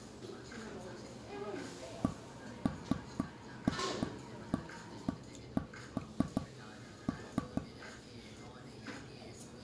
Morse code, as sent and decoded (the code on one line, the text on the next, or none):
none